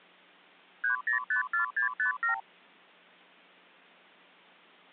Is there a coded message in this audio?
Yes: multi-frequency trunk signalling (R2, with the far end's replies) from 0.8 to 2.4 s, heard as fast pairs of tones, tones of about 120 ms. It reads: 3054657